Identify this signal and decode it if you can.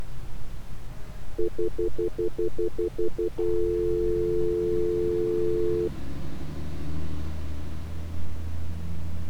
Telephone call progress tone (North American plan), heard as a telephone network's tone, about 350, 440 Hz, 0.1 s on and 0.1 s off, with street noise. Stutter dial tone.